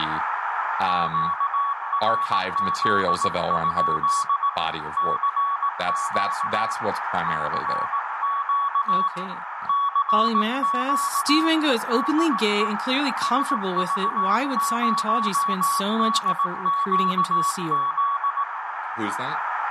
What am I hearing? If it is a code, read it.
Morse code, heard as a keyed tone, hand-sent with a paddle, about 18 wpm, 1120 Hz, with radio static, a narrow filter, room echo and speech in English. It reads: QRZ? CQ CQ CQ DE SV0DQZ